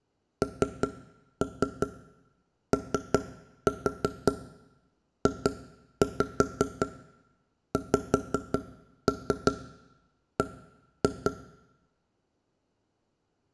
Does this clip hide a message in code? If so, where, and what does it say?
Yes: tap code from 0.4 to 11.3 s, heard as knocks on wood, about 5 knocks a second, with room echo. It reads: NOJXB